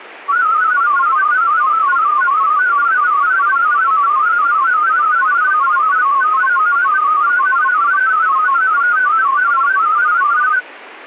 Multi-tone FSK (Olivia or MFSK type), about 500 Hz wide, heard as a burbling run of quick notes, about 31.25 baud.